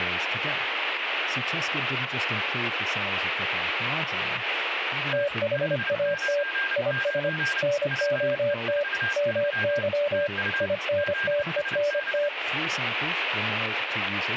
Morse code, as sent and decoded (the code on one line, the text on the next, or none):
- .... .- - / .. ... / -. --- - / -- -.-- / .. -. - . -. -
THAT IS NOT MY INTENT